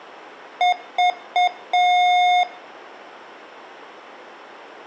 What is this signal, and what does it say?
Beep code, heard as beeps from a small speaker, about 720 Hz, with room echo. 3 short, 1 long.